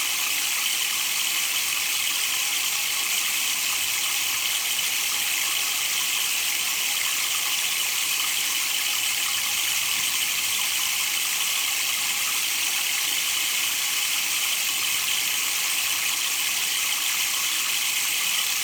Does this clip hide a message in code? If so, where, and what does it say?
No.